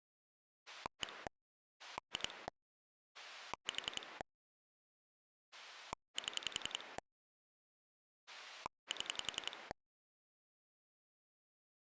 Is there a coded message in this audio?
Yes: pulse dialling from 0.7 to 9.7 s, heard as a rotary dial, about 11 pulses a second. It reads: 1 2 4 7 7